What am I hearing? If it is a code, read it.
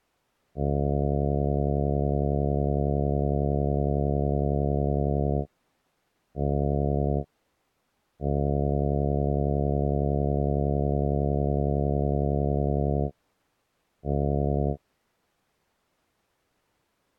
Ship horn signal, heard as a ship's horn, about 70 Hz. 1 long, 1 short, 1 long, 1 short. At sea: I agree to be overtaken.